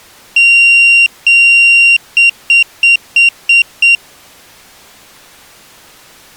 Beep code, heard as a piezo beeper, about 2750 Hz. 2 long, 6 short.